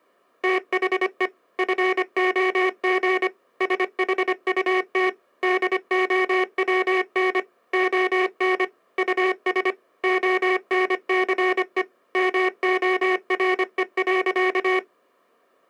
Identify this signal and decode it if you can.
Morse code, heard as a buzzer, machine-sent, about 25 wpm. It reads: THE FOG SHUT DOWN ON US ONCE MORE.